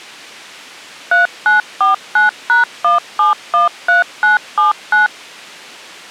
DTMF, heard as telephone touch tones, dialled by machine, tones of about 140 ms. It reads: 3949#1713979